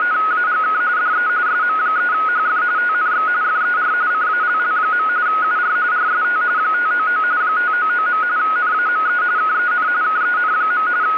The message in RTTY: … DE SM3HF TNX FER CALL. UR RST 599 599. NAME KEN KEN. …

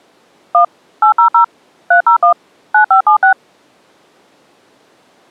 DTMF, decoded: 1 800 301 9576

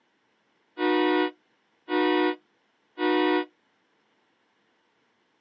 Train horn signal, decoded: 3 short

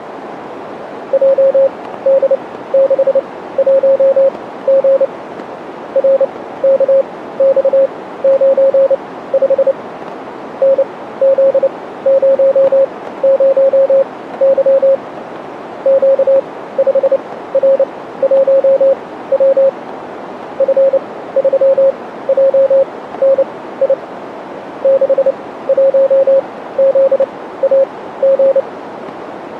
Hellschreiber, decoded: none

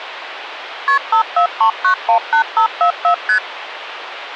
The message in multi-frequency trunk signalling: KP 543918544 ST

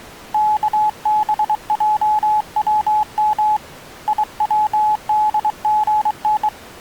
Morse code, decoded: KBJWM IWDGN

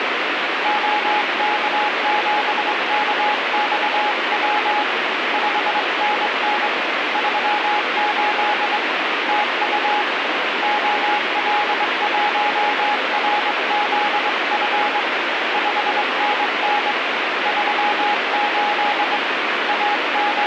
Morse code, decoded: OK7KXW 5NN 38 TU OL1RZF 5NN 38 …

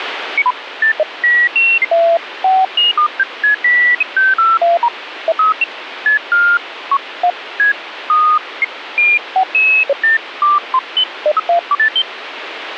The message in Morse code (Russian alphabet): none

